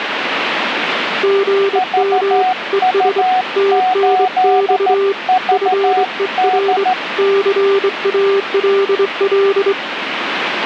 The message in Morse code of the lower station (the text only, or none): GM ES TNX FER CALL